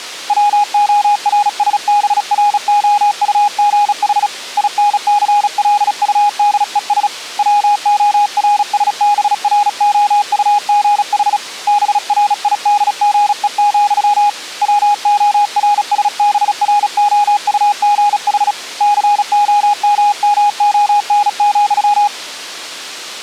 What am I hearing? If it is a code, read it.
Morse code, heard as a keyed tone, hand-sent with a bug key, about 36 wpm, 830 Hz. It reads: WORSBROUGH INCLUDES WORSBROUGH BRIDGE, WORSBROUGH COMMON,